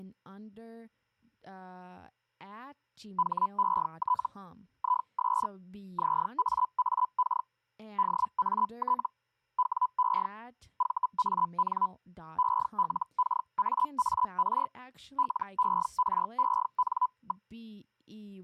Hellschreiber (Feld-Hell, 122.5 baud), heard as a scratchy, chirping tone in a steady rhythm, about 1000 Hz, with speech in English. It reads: HET IS ZAAK DAT WE VAN ELKAAR LEREN.